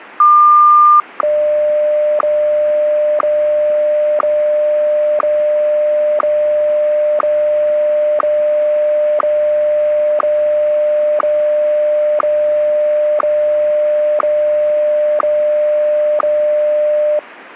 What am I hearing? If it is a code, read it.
Radio time signal (WWVH, Hawaii), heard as ticks, one a second.